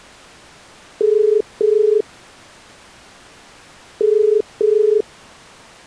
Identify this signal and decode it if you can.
Telephone call progress tone (as in the UK, Ireland, Australia and similar networks), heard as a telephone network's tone, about 430 Hz. Ringback tone.